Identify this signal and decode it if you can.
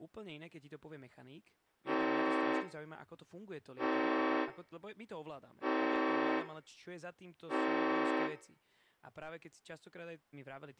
Train horn signal, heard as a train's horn, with room echo and speech in Slovak. 4 short. On North American railways: a request for a signal to be given or repeated.